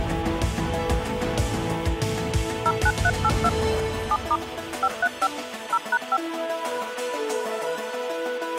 DTMF, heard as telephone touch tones, dialled by machine, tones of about 50 ms. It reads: 09382 7* 535 0#5